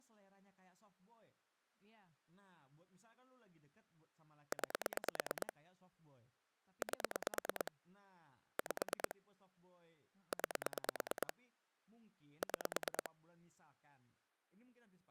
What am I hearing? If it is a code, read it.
Pulse dialling, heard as clicks on a phone line, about 9 pulses a second, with speech in Indonesian. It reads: 9 8 5 9 6